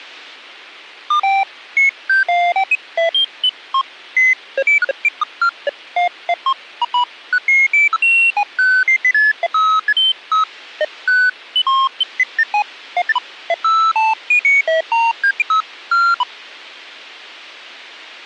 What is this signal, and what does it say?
Electronic bleeps of random pitch and length. There is no code.